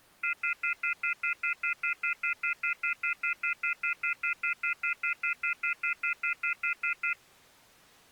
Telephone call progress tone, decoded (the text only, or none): off-hook warning tone